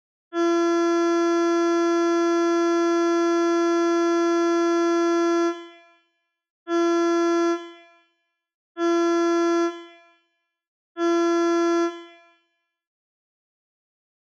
Ship horn signal, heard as a ship's horn, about 340 Hz, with room echo. 1 long, 3 short. At sea: a vessel under tow in fog.